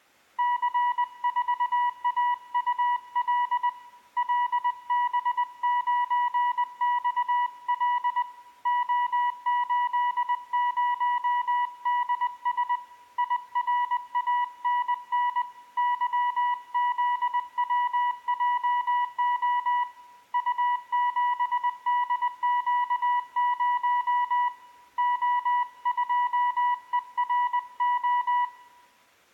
Morse code, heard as a keyed tone, hand-sent with a paddle, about 20 wpm, 980 Hz, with room echo. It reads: C4AUL LB9XL O80DS IRANN YZWJO U7DQ0 O2ERO